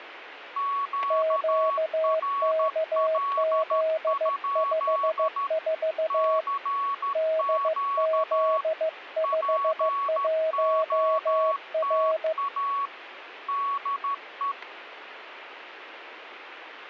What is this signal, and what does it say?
Morse code, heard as two keyed tones, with radio static and static crashes. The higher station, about 13 wpm, 1120 Hz: QRL? CQ POTA DE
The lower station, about 15 wpm, 640 Hz: QKZ54 DZ51R